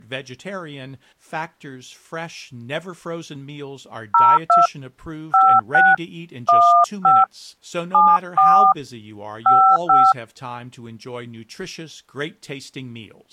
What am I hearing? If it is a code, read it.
DTMF, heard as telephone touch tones, dialled by hand, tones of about 270 ms, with speech in English. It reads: 02 56 15 74 55